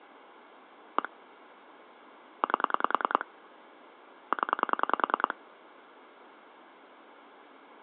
Pulse dialling, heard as clicks on a phone line, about 10 pulses a second, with phone line noise. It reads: 1 8 0